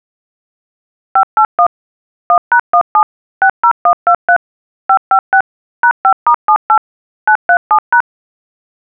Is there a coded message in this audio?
Yes: DTMF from 1.2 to 8.0 s, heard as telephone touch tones, dialled by machine, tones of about 80 ms. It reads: 581 1#17 60123 556 #5*78 937#